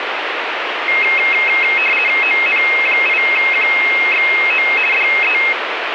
RTTY (50 baud, 450 Hz shift), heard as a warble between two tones, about 2350 Hz centre, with radio static. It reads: ON8QXO DE